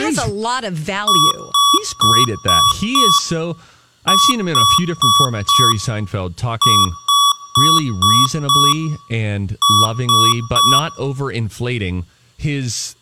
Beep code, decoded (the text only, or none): 5-4-5-3